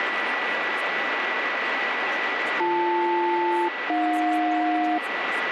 Aircraft SELCAL, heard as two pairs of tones, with radio static, a steady whistle near 1960 Hz and speech in English. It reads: BL-AJ